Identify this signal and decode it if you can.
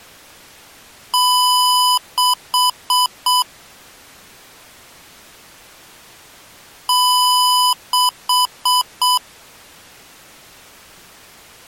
Beep code, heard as beeps from a small speaker, played twice, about 1000 Hz. 1 long, 4 short.